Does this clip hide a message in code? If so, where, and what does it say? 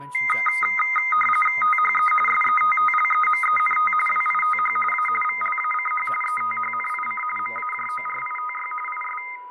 Yes: RTTY (45.45 baud, 850 Hz shift) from 0.1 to 9.4 s, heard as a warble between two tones, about 1650 Hz centre, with fading, a steady whistle near 990 Hz and speech in English. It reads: THE SETTLEMENT WITH A VLACH ETHNIC MAJORITY IS